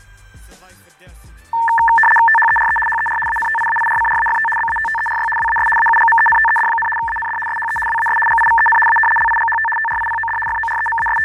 RTTY (75 baud, 850 Hz shift), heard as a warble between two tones, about 1340 Hz centre, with fading. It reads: THERE HER ANTIAIRCRAFT BATTERY WAS AUGMENTED, AND SHE WAS GIVEN A LIGHT TRIPOD …